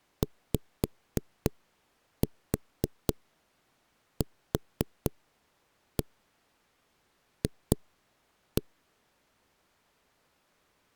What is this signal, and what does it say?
Tap code, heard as knocks on a wall, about 3 knocks a second. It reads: YQF